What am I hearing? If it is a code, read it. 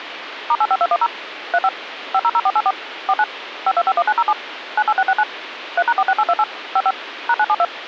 DTMF, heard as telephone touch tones, dialled by machine, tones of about 50 ms, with phone line noise. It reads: *85210 35 500484 49 5251907 98669 3#46828 55 #972